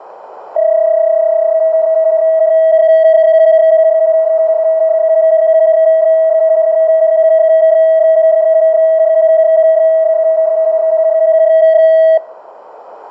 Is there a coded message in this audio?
Yes: PSK31 (31.25 baud) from 0.6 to 12.2 s, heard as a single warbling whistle, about 640 Hz, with radio static and room echo.